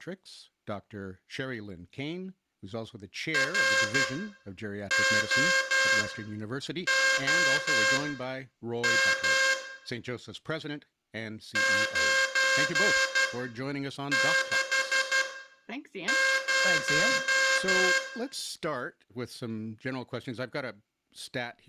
Morse code, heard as a buzzer, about 12 wpm, spaced as for 7 wpm, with room echo and speech in English. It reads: ROOM 960